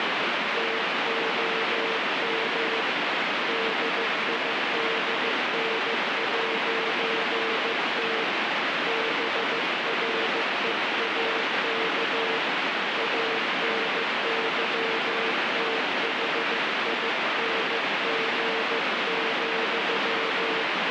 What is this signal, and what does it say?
Morse code, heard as a keyed tone, hand-sent with a paddle, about 15 wpm, 450 Hz, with heavy radio static. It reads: TOM DIDN'T BREAK ANYTHING,